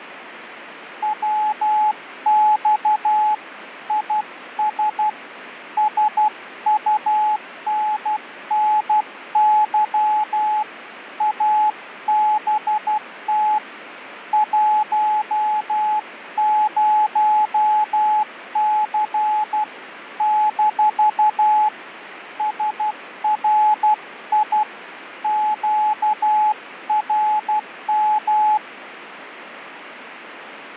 Morse code, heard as a keyed tone, hand-sent with a paddle, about 12 wpm, 850 Hz, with radio static. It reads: WX IS SUNNY ABT 10C - SRI QRM